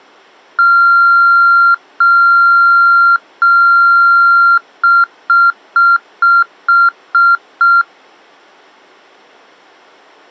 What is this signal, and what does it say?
Beep code, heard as beeps, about 1380 Hz. 3 long, 7 short.